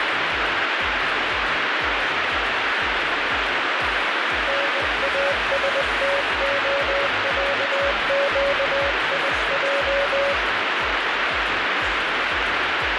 Morse code (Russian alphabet), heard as a keyed tone, hand-sent with a bug key, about 20 wpm, 560 Hz, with heavy radio static. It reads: НАСТОЯЩИЙ